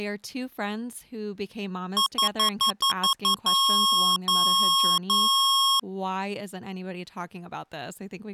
Beep code, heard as beeps from a small speaker, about 1090 Hz, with speech in English. 7 short, 3 long.